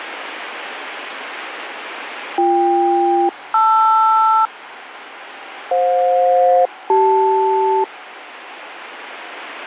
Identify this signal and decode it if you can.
Aircraft SELCAL, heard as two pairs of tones, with the noise inside a subway train. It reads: BK-LR FJ-CL